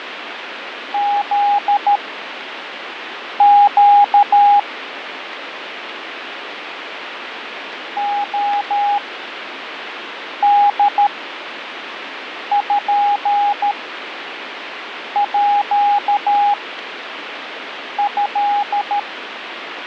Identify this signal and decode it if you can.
Morse code (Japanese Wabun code), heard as a keyed tone, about 13 wpm, spaced as for 5 wpm, 820 Hz, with radio static and fading. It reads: フネ レポート